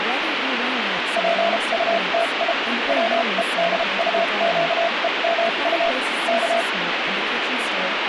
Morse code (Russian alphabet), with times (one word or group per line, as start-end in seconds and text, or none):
1.2-2.5 ПУТИ
2.9-5.9 ВЕДУЩЕМУ
6.3-6.6 К